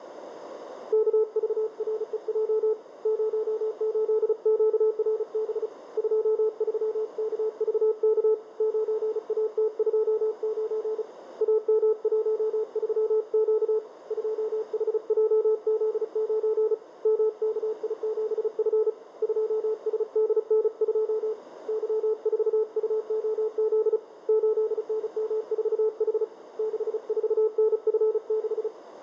Morse code, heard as a keyed tone, hand-sent with a paddle, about 35 wpm, 440 Hz, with radio static and a narrow filter. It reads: KVREJ 08QRB 23KVK 9AT29 AM13Q 2HJZ9 MKI7F 2SDN2 Y4UOZ 8NM4H 64NF6